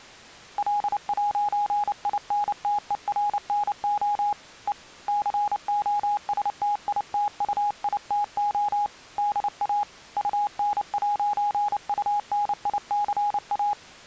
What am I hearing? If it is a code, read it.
Morse code, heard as a keyed tone, hand-sent with a paddle, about 29 wpm, 830 Hz. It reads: L'INTERNO E COSTITUITO DA UN'UNICA